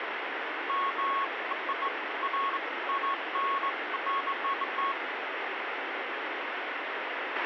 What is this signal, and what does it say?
Beeps of irregular length, with radio hiss, a squelch burst at the end and room echo. There is no code.